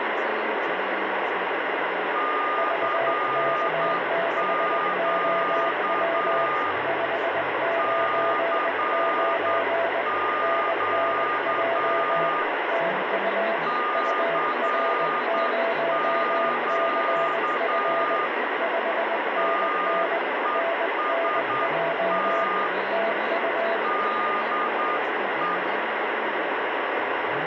Morse code, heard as two keyed tones, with heavy radio static. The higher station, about 9 wpm, 1220 Hz: CQ CQ CQ TEST DE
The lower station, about 20 wpm, 670 Hz: VK6OW 599 NNJ TU UR0CF 5NN NNJ TU